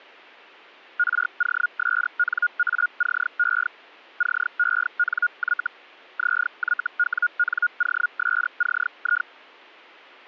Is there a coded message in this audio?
Yes: Hellschreiber (Feld-Hell, 122.5 baud) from 1.0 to 9.3 s, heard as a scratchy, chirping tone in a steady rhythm, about 1440 Hz. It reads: ROSNACE CENY ZYWNOSCI